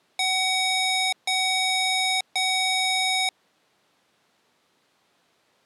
Beep code, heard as beeps from a small speaker, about 750 Hz. 3 long. In IBM BIOS tables: keyboard card error.